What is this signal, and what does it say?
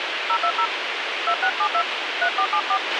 DTMF, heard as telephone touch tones, dialled by hand, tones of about 80 ms, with radio hiss and a squelch burst at the end. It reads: 020 2672 3474